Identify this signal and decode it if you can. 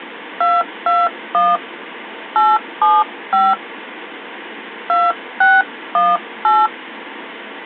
DTMF, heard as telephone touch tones, dialled by hand, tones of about 210 ms. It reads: 221 875 2618